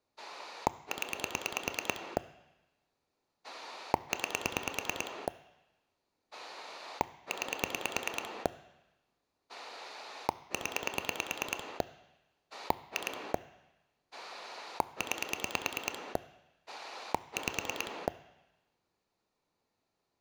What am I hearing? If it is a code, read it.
Pulse dialling, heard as a rotary dial, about 9 pulses a second. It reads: 0 9 9 0 2 9 5